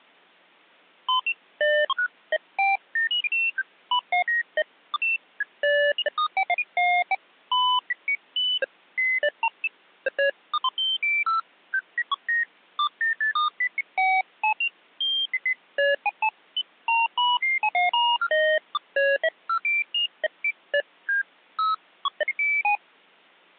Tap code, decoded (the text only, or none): none